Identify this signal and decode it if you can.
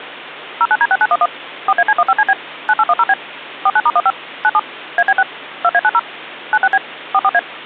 DTMF, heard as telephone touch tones, dialled by machine, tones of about 50 ms, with phone line noise and hum. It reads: 09D6911 4AC15CB 9810B 49*15 97 AB6 2A90 96B 44A